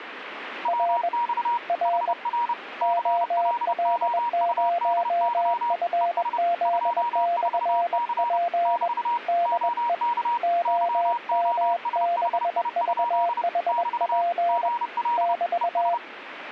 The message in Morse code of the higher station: WX HR CLOUDY ES 24C <BT> OK YOSHI? <BT> GL ES

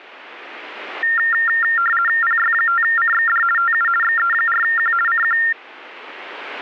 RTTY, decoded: PY5CXD TU XE4Q CQ

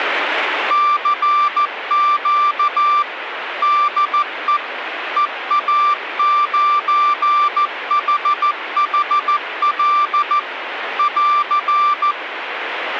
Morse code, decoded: CQ DE EA9HHL <AR>

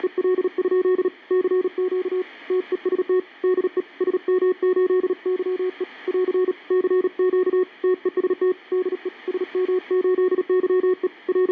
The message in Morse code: … CQ TEST DE SM8YE <AR> CQ TEST DE SM8YE …

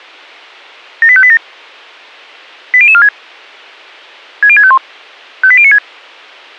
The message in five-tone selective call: 78587 80046 60651 58096

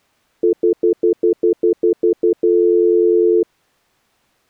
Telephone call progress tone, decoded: stutter dial tone

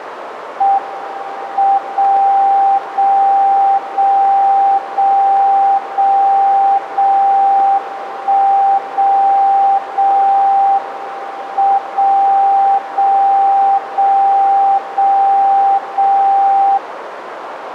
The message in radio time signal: M 0 0 0 0 0 0 1 0 0 M 0 0 0 0 0

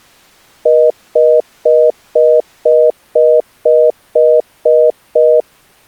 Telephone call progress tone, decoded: congestion tone

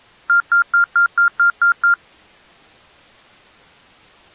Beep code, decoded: 8 short

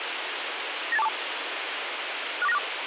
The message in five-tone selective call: 98242 64964

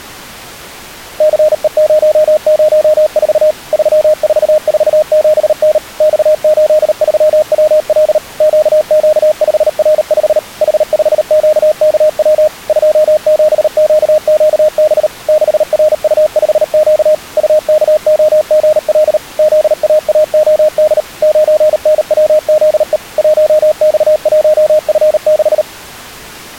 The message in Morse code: CE004 3447N X83WL QQ5R5 H5QKW 27QQB 6RU5Q UKOGL ZAAOD 9NWZE 1X1F6

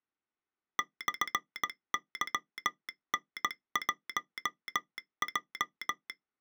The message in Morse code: /YN1J

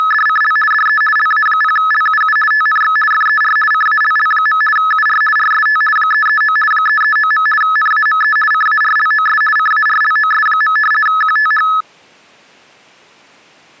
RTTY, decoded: … DE LA0LUU TNX FER CALL. UR RST 339 339. NAME CARLOS CARLOS. QTH

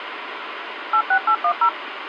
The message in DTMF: 86810

